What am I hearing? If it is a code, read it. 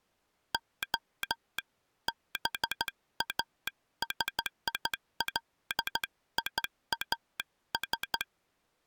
Morse code (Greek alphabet), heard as a telegraph sounder, hand-sent with a straight key, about 14 wpm. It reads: Ο ΒΑΣΙΛΙΑΣ